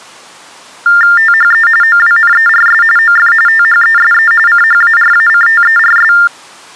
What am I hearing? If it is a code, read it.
TTY/TDD text telephone tones (45.45 baud Baudot), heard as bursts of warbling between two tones, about 400 Hz shift, 1600 Hz centre. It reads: THE OWNERS OF THESE CHARACTERS